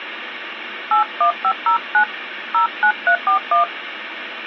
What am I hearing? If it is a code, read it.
DTMF, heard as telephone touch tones, dialled by hand, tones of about 100 ms, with phone line noise. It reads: 81509 09341